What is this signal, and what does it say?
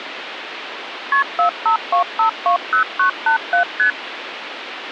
Multi-frequency trunk signalling (R1, as on North American trunks), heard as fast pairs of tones, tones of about 110 ms, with phone line noise. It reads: KP 452520987 ST